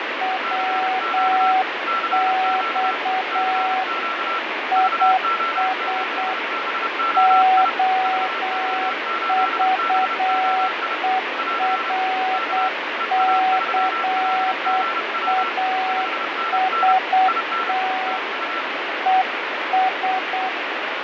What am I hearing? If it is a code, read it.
Morse code, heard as two keyed tones, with heavy radio static and fading. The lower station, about 8 wpm, 750 Hz: WX IS OVERCAST ES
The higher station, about 30 wpm, 1350 Hz: CQ CQ CQ VO8BOI VO8BOI <AR> K EA3LGW 5NN IN TU